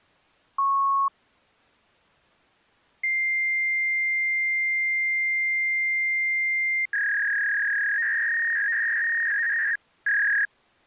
Fax machine handshake, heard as a beep, a long tone and a warble.